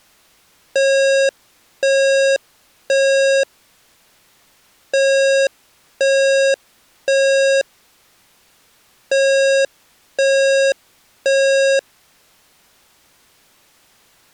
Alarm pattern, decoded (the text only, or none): temporal three